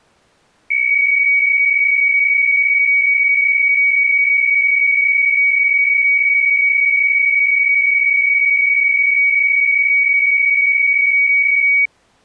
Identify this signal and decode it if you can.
PSK63 (62.5 baud), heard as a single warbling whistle, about 2250 Hz.